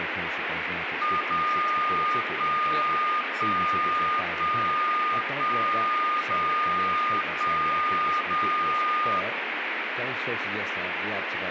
Radio time signal (DCF77), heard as a tone whose level steps once a second, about 1220 Hz, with radio static and speech in English. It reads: 0 1 1 1 1 0 1 0